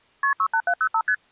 Multi-frequency trunk signalling (R1, as on North American trunks), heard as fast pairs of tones, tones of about 70 ms. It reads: KP 68705 ST